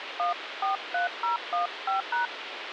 DTMF, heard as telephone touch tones, dialled by hand, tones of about 130 ms, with radio hiss. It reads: 143015#